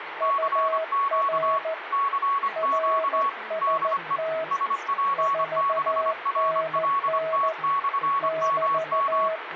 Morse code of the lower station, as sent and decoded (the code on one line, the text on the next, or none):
..- .-. / .-. ... - / ....- -. -. / -...-
UR RST 4NN <BT>